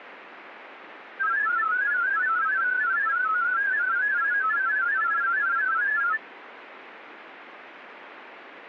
Multi-tone FSK (Olivia or MFSK type), about 500 Hz wide, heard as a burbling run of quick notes, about 31.25 baud.